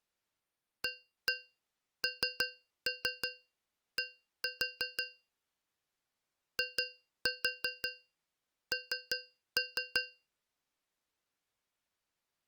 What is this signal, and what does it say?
Tap code, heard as taps on a metal pipe, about 5 knocks a second. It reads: AND IN